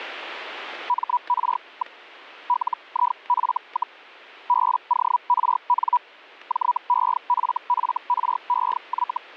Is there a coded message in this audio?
Yes: Hellschreiber (Feld-Hell, 122.5 baud) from 0.9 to 9.2 s, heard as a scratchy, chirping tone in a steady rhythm, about 980 Hz, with static crashes. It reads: MR. LIF, BORN JEFFREY